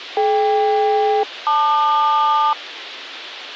Aircraft SELCAL, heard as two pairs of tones. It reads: DK-LQ